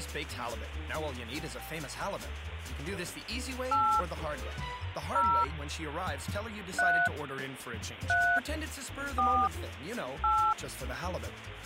DTMF, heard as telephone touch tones, dialled by hand, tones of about 290 ms. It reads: 8 0 3 3 4 8